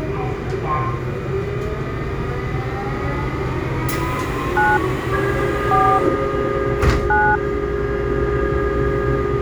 DTMF, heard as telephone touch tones, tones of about 230 ms, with the noise inside a subway train. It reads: 9 4 9